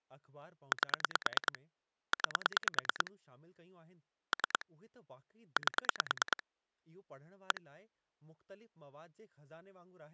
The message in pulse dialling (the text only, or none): 8 9 3 8 1